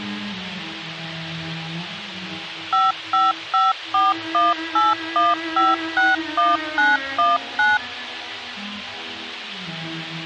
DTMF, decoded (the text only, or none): 5554181561919